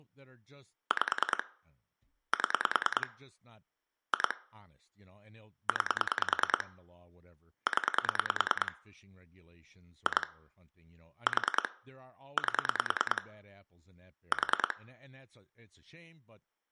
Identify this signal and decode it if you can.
Pulse dialling, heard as clicks on a phone line, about 10 pulses a second, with room echo and speech in English. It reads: 5 7 2 9 0 2 4 8 4